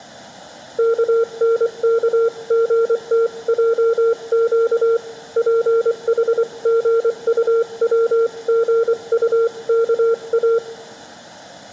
Morse code (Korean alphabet), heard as a keyed tone, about 24 wpm, 460 Hz, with room echo. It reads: 용서해 주십시오